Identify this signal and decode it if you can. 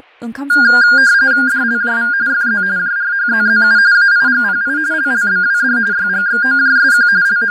RTTY (45.45 baud, 170 Hz shift), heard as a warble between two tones, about 1500 Hz centre, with fading and speech in Bodo. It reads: DLJV FZ JRHZZU AIGPI LLBWD YGXOJSQ …